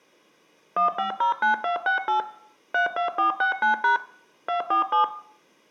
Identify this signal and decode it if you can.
DTMF, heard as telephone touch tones, dialled by machine, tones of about 120 ms, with room echo. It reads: 1509268 32469# 247